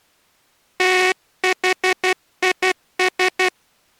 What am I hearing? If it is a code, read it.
Morse code, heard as a buzzer, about 12 wpm. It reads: THIS